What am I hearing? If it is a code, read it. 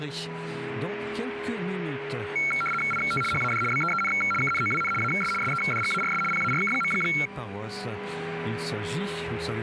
RTTY (75 baud, 850 Hz shift), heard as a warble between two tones, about 1800 Hz centre, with a steady whistle near 410 Hz. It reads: IT HAD BEEN KNOWN AS SEDGARS PARK.